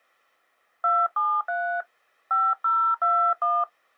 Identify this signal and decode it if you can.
DTMF, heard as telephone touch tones, dialled by hand, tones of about 240 ms. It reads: 273 5021